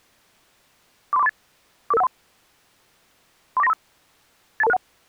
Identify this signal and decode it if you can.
Five-tone selective call (EIA), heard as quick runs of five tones, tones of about 30 ms. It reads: 43438 44513 34935 82261